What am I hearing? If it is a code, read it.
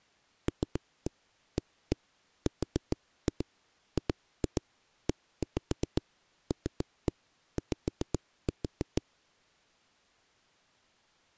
Tap code, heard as knocks on a wall, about 7 knocks a second. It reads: LARGELY